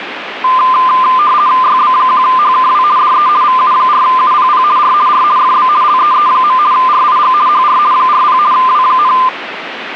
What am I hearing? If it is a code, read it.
RTTY (50 baud, 170 Hz shift), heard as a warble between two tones, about 1110 Hz centre, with radio static. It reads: YB1HKW DE VU4UPP R R FB LEE. RIG HR 40 W,